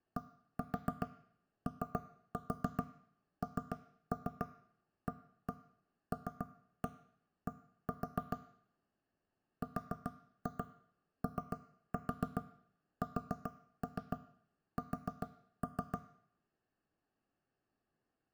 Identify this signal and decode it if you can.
Tap code, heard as knocks on wood, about 7 knocks a second, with room echo. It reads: DONALD ROSS